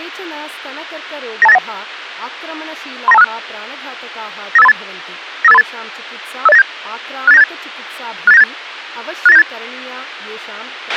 Five-tone selective call (EIA), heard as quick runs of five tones, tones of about 30 ms, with a squelch burst at the end and speech in Sanskrit. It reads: 92891 39256 95838 95838 50897 68978 68978 68978